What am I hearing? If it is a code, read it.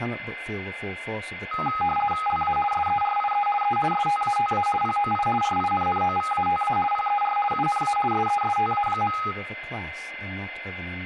RTTY (50 baud, 450 Hz shift), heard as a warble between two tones, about 1040 Hz centre, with a steady whistle near 2070 Hz and speech in English. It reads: LA SERIE E STATA POI RINNOVATA PER UNA SESTA.